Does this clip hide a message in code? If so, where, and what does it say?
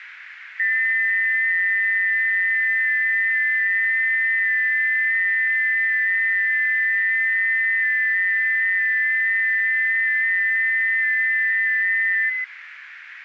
Yes: FT8 (several signals at once) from 0.6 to 12.4 s, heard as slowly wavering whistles, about 6.25 baud, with radio static.